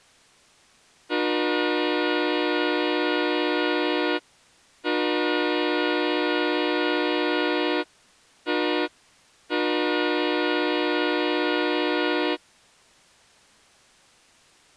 Train horn signal, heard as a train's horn. 2 long, 1 short, 1 long. On North American railways: approaching a public crossing.